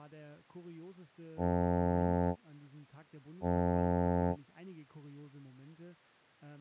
Ship horn signal, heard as a ship's horn, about 90 Hz, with speech in German. 2 short. At sea: I am altering course to port.